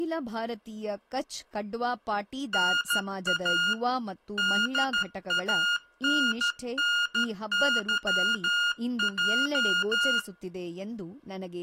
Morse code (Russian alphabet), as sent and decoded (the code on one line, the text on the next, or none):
-. .- / -.. .- -. -. -.-- .---
НА ДАННЫЙ